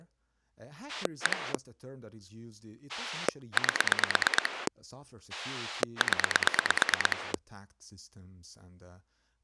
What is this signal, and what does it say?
Pulse dialling, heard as a rotary dial, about 9 pulses a second, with speech in English. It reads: 1 8 0